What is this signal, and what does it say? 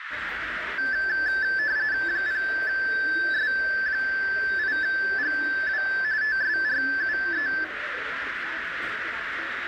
RTTY (45.45 baud, 170 Hz shift), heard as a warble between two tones, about 1650 Hz centre, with radio static, a narrow filter and the noise of a subway station. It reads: 0S8GW TSRUE